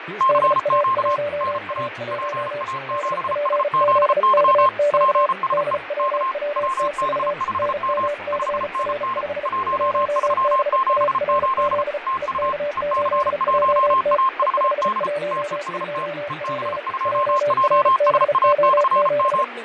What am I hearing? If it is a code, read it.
Morse code, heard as two keyed tones, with radio static, fading and speech in English. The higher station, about 34 wpm, 1060 Hz: CQ NA PA7SZY PSE K WB5M 5NN 1378 TU EC1AVD TEST EB2JSA/M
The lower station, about 35 wpm, 580 Hz: DA1A1 DPZKQ DWWTV NMCR5 1BARZ EK8JT E512P JRBO7